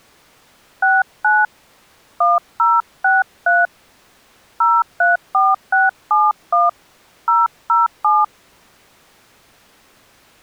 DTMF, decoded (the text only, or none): 69 1063 034671 007